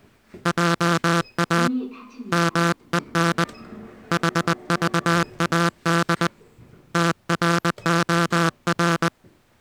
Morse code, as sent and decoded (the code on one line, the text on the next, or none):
.--- .- / -- . -. / .... ...- .- -.. / - .-. --- .-.
JA MEN HVAD TROR